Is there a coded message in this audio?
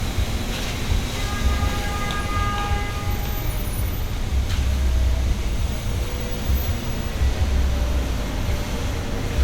No, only street noise.